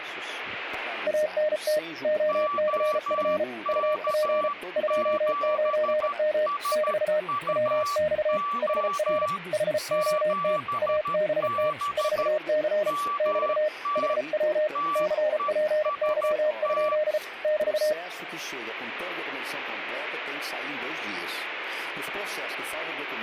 Morse code, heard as two keyed tones. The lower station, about 34 wpm, 610 Hz: ANT OCF UP 29M <BT> WX HR HOT ABT 4C <BT> HW CPY? <BT>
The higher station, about 13 wpm, 1160 Hz: OK7SUO 7B MT TEST